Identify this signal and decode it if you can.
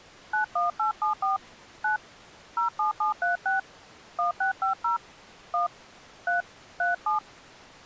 DTMF, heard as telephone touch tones, dialled by hand, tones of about 130 ms. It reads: 91874 9 07736 1650 1 3 37